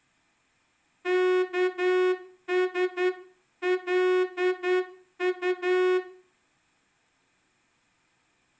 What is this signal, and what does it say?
Morse code (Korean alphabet), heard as a horn, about 10 wpm, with room echo. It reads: 여기